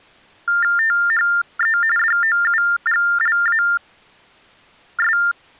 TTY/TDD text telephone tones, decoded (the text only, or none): THE DOUGLAS